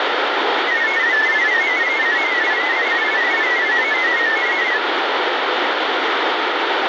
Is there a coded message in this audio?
Yes: multi-tone FSK (Olivia or MFSK type), about 500 Hz wide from 0.7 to 4.8 s, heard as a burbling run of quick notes, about 31.25 baud, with radio static.